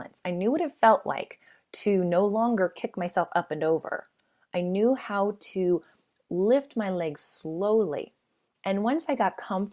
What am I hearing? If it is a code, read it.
Speech in English. There is no code.